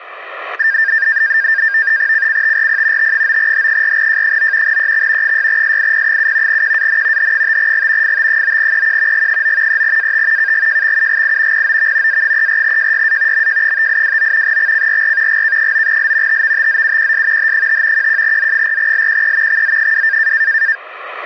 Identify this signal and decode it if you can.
NAVTEX (SITOR-B), 100 baud, 170 Hz shift, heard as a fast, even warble, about 1700 Hz centre, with static crashes. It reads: CCTRP T9H4J9 EX 6SIP7 QAN H5G FT9EQ G9 3AT KGJXUGI POV A34JYA MJ5829 XCRR GK9L TVTZUQS H5 11Z4LQE XZ2